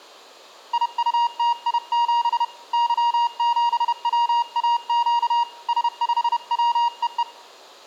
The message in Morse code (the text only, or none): IUTI7 Y7WAQ S5WEE